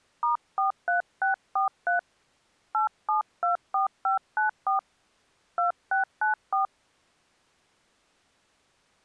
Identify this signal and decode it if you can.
DTMF, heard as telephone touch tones, dialled by hand, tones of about 130 ms. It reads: *43643 8724594 2694